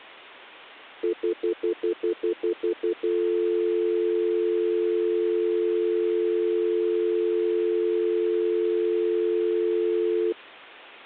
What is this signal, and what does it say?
Telephone call progress tone (North American plan), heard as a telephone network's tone, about 350, 440 Hz, 0.1 s on and 0.1 s off. Stutter dial tone.